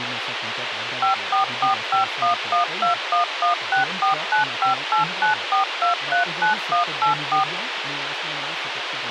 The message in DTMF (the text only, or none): 5445112116495894239184